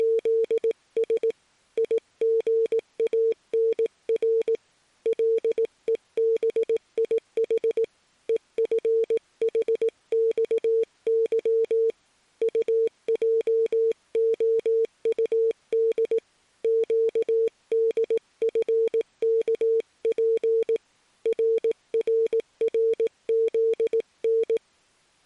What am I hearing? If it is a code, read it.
Morse code, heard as a keyed tone, hand-sent with a paddle, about 18 wpm, 450 Hz. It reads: … IGANR LEBIH EFHXY UJOUD QDFKP RRRZN